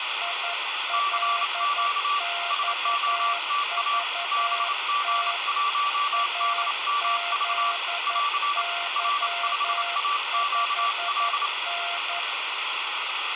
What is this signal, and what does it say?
Morse code, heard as two keyed tones, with radio static and room echo. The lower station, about 11 wpm, 690 Hz: ILXVT AZY5N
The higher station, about 28 wpm, 1160 Hz: CQ SOTA BG1DMV <AR> R5AQL